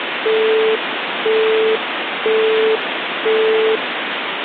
Telephone call progress tone (single-tone plan, as in Europe, Japan and elsewhere), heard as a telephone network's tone, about 440 Hz, 0.5 s on and 0.5 s off, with phone line noise. Busy tone.